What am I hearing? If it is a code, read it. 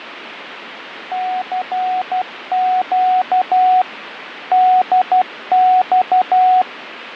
Morse code, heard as a keyed tone, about 12 wpm, 740 Hz, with radio static and fading. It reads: CQ DX